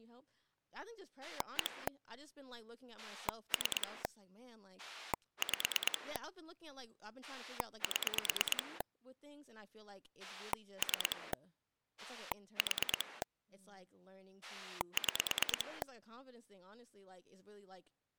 Pulse dialling, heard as a rotary dial, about 9 pulses a second, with speech in English. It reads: 1 3 5 7 3 4 6